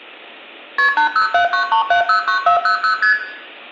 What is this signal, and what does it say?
Multi-frequency trunk signalling (R1, as on North American trunks), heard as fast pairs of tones, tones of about 110 ms, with room echo. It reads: KP 80793709400 ST